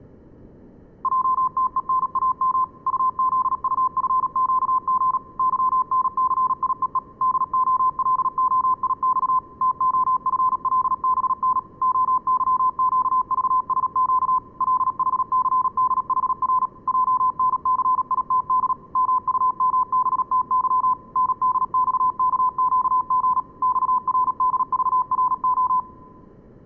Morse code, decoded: JTENAM UZUFQG YNCIEE DOLOIX TOFLBN OYQVSQ LHCDHR JNCITD MUMBTY NDXKQG XRDVRO

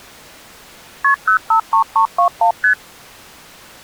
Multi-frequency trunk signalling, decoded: KP 053321 ST

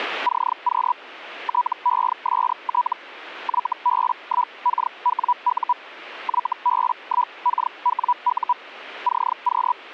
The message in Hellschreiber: CQ TEST YB1KWU YB1KWU CQ

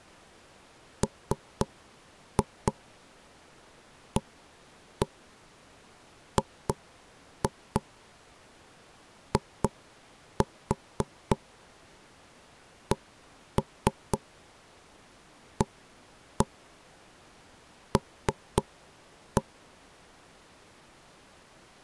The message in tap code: MAGICAL

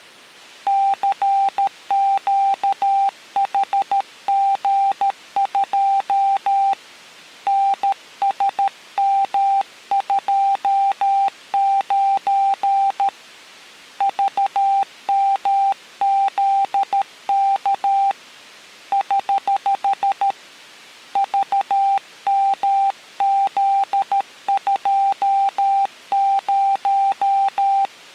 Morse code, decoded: CQHG2 NSM29 VMZK <HH> VMZ20

